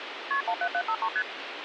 Multi-frequency trunk signalling (R1, as on North American trunks), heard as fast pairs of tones, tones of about 70 ms, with phone line noise. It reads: KP 17753 ST